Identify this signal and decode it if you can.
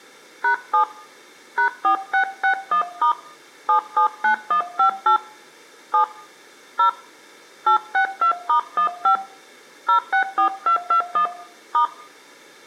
DTMF, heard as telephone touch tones, dialled by hand, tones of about 100 ms, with room echo. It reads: #7 #4661* 779158 7 0 862*15 064221 *